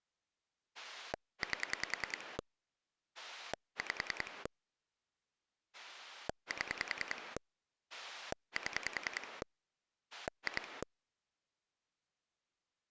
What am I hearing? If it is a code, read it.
Pulse dialling, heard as a rotary dial, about 10 pulses a second. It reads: 8 5 7 7 2